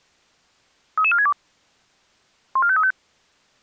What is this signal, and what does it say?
Five-tone selective call (ZVEI), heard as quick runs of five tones, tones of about 70 ms. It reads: 33462 14535